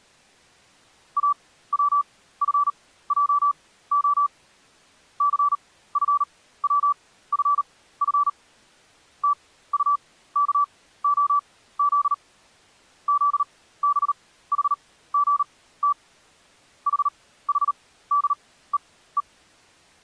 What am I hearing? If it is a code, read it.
Morse code, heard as a keyed tone, machine-sent, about 38 wpm, spaced as for 17 wpm, 1160 Hz. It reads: AWFJO CFWFF TUKOZ ZBHGT HHDEE